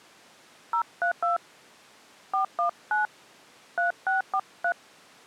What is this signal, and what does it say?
DTMF, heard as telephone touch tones, dialled by hand, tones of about 100 ms. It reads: 032 419 3643